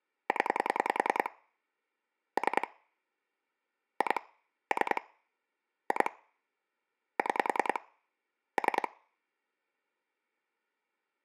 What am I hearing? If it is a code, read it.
Pulse dialling, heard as clicks on a phone line, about 10 pulses a second. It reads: 0 3 2 3 2 6 3